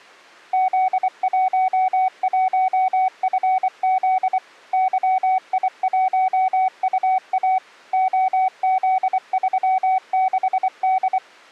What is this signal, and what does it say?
Morse code, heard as a keyed tone, machine-sent, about 24 wpm, 750 Hz. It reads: Z11FZ YI1UA OZ36D